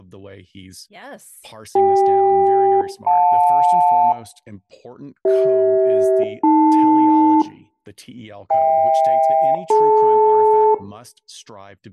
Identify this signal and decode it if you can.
Aircraft SELCAL, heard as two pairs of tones, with room echo and speech in English. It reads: CK-JL CH-AL HK-DL